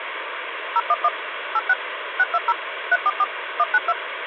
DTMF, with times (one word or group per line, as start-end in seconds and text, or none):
0.8-1.1 011
1.5-1.7 86
2.2-2.5 620
2.9-3.2 344
3.6-3.9 192